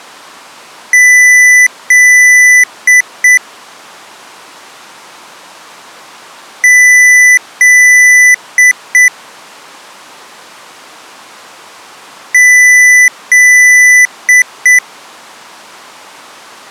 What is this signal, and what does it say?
Beep code, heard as beeps from a small speaker, played three times, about 2000 Hz. 2 long, 2 short.